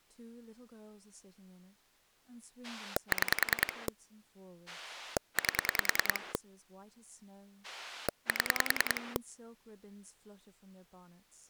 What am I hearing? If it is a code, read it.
Pulse dialling, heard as a rotary dial, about 10 pulses a second, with speech in English. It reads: 6 8 7